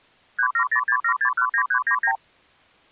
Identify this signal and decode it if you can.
Multi-frequency trunk signalling (R2, with the far end's replies), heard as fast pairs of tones, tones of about 80 ms. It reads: 37067619399